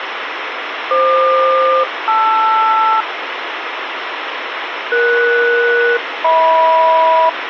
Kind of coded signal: aircraft SELCAL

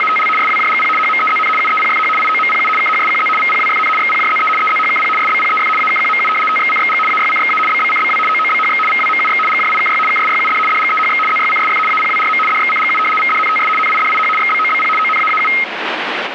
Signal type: RTTY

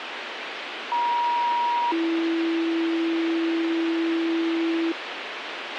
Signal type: two-tone page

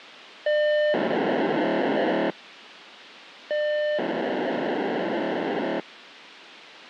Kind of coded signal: POCSAG pager data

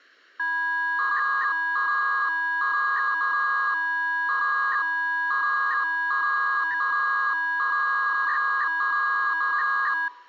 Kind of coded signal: 300-baud modem data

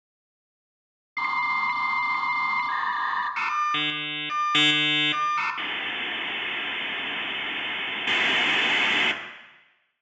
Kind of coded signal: dial-up modem handshake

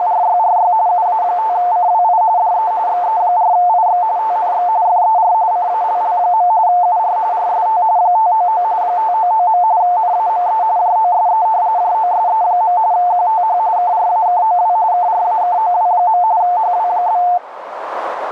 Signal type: RTTY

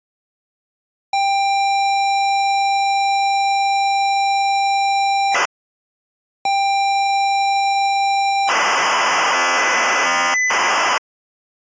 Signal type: ZX Spectrum tape loading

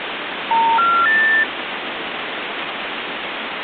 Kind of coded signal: telephone call progress tone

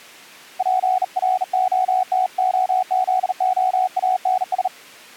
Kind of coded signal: Morse code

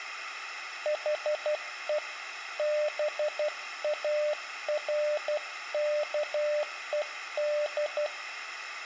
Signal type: Morse code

